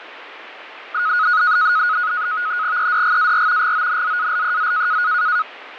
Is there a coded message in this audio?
Yes: NAVTEX (SITOR-B), 100 baud, 170 Hz shift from 0.9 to 5.4 s, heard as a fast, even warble, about 1360 Hz centre, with radio static. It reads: EDGAR GONZALEZ